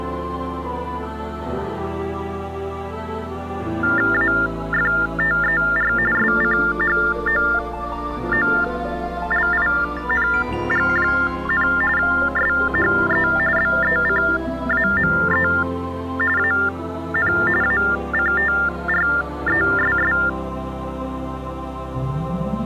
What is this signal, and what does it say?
TTY/TDD text telephone tones (45.45 baud Baudot), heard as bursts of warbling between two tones, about 400 Hz shift, 1600 Hz centre. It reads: AFTER SCHOOLING, SHE BECAME AN ACTRESS